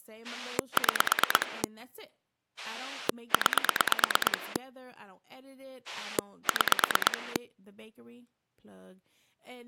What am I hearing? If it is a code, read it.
Pulse dialling, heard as a rotary dial, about 9 pulses a second, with speech in English. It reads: 6 9 6